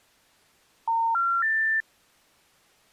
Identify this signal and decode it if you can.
Telephone call progress tone (North American plan), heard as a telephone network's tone, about 910, 1370, 1800 Hz. Special information tone.